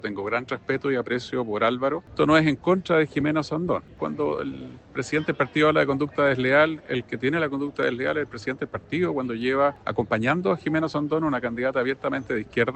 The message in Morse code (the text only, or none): none